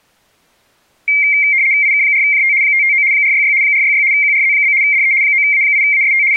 RTTY (75 baud, 170 Hz shift), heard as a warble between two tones, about 2200 Hz centre. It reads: IK4JT 559 466 466 QRZ? DE 9A8AST …